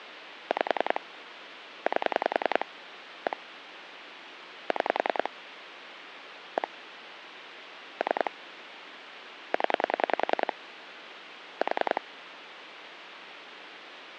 Pulse dialling, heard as clicks on a phone line, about 10 pulses a second, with phone line noise. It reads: 5 8 1 6 1 3 0 4